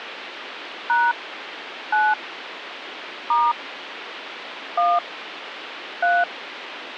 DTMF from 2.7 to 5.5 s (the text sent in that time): * 1